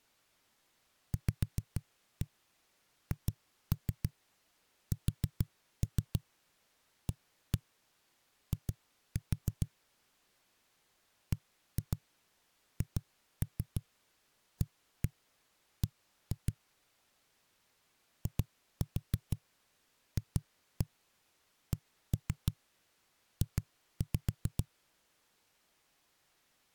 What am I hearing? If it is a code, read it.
Tap code, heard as knocks on a wall, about 6 knocks a second. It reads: VHSAI BHAB IFCJ